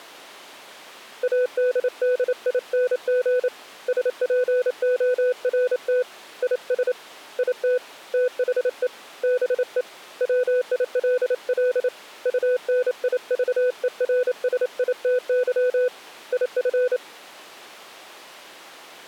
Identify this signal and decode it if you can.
Morse code, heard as a keyed tone, hand-sent with a paddle, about 28 wpm, 500 Hz. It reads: ADDING SPORT IS IT THE BE WILL UNIVERSITY IF